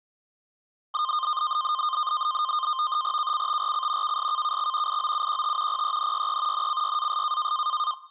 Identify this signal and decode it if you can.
NAVTEX (SITOR-B), 100 baud, 170 Hz shift, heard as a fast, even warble, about 1130 Hz centre. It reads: KCTRC KSKKX IOUQT PENYE NCYAS